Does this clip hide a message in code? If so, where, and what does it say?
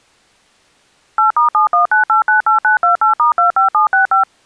Yes: DTMF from 1.2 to 4.2 s, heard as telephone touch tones, dialled by machine, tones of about 120 ms. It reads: 8*719898928*25765